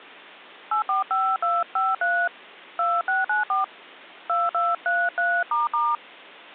DTMF, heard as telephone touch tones, dialled by hand, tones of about 190 ms. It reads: 845253 2694 2233**